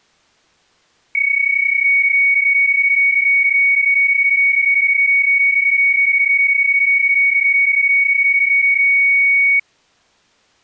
PSK31 (31.25 baud), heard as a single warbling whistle, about 2250 Hz.